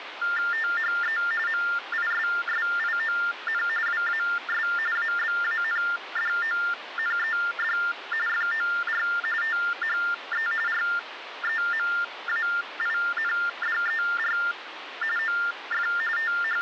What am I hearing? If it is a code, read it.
TTY/TDD text telephone tones (45.45 baud Baudot), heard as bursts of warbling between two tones, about 400 Hz shift, 1600 Hz centre, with phone line noise. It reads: THE MISSION WAS ABANDONED FOR THE REMAINDER OF …